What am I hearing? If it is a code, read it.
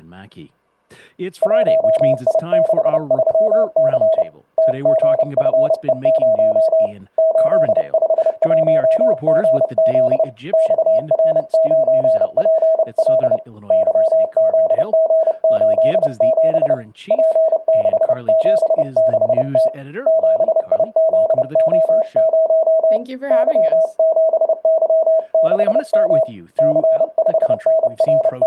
Morse code, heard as a keyed tone, hand-sent with a paddle, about 30 wpm, 640 Hz. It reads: 1I63C TGFE0 851GZ XR9PL YZG87 P676T 7IZO0 Y7Y6M …